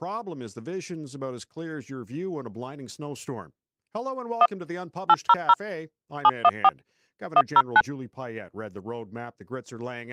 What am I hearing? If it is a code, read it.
DTMF, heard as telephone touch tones, dialled by machine, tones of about 50 ms, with speech in English. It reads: 1 800 714 109